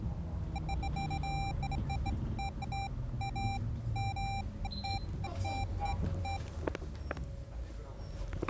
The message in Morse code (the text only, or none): none